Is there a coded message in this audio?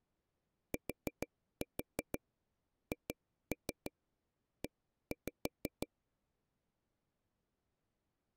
Yes: tap code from 0.7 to 5.9 s, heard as taps on a table, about 6 knocks a second. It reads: THE